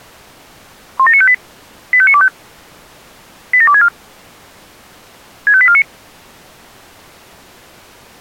Five-tone selective call (ZVEI), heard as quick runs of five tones, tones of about 70 ms. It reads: 17958 85925 87264 65849